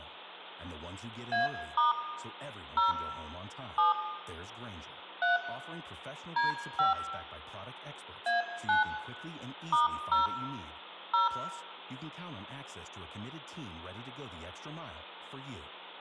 DTMF, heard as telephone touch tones, dialled by hand, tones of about 150 ms, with hum, room echo and speech in English. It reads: A* 0 7 3 D5 A9 *0 0